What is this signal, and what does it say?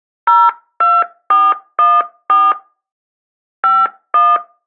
DTMF, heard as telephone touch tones, dialled by hand, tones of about 220 ms. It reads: 02414 51